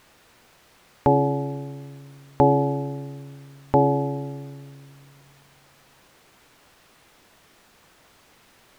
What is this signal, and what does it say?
Clock strike, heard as a bell. 3. Three o'clock.